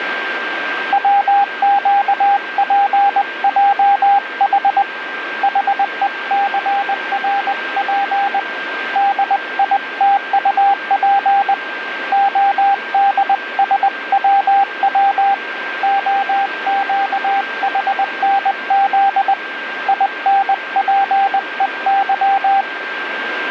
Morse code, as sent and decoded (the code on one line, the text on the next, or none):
.-- --.- .--. .--- .... / .... . -.-. .-. .--. / -.. .. - ..- .--. / --- -.. ... .-- .-- / --- --.- .... -. --.. / .. -. .--. . -.--
WQPJH HECRP DITUP ODSWW OQHNZ INPEY